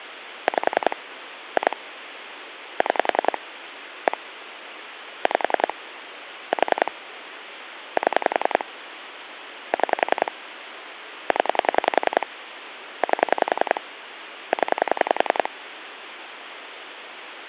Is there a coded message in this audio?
Yes: pulse dialling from 0.5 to 15.5 s, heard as clicks on a phone line, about 10 pulses a second, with phone line noise. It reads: 5 2 6 1 5 4 7 6 0 8 0